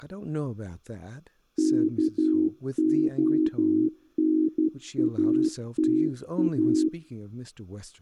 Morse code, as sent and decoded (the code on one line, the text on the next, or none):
-.- --- -. .- - .-
KONATA